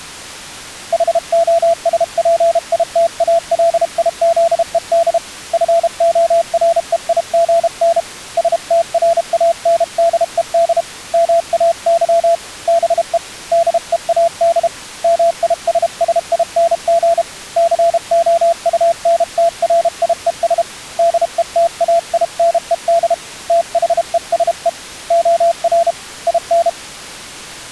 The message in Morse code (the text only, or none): HOSPITALIZED FOREIGN STRANDED MAY BE DEAD MISSING COUNTRIES DETAINED THESE OR IN